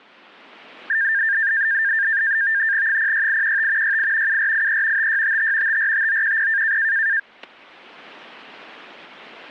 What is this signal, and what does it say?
NAVTEX (SITOR-B), 100 baud, 170 Hz shift, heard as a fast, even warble, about 1700 Hz centre, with static crashes. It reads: 06815 68 7483 5655 545910